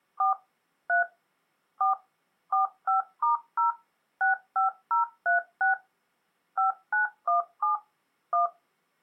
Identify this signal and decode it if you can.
DTMF, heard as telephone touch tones, dialled by machine, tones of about 130 ms. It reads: 4 3 4 45*0 65036 5917 1